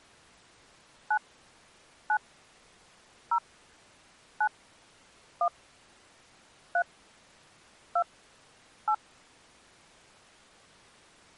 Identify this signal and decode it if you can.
DTMF, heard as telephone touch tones, dialled by hand, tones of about 70 ms. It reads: 9 9 0 9 1 3 2 8